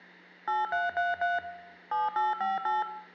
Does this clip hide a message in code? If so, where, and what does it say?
Yes: DTMF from 0.5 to 2.8 s, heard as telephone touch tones, dialled by machine, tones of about 170 ms, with hum and room echo. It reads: 8333 7858